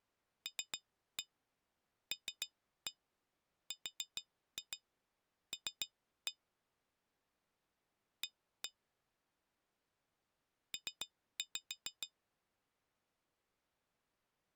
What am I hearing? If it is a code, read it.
Tap code, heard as taps on glass, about 7 knocks a second. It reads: LLRL A P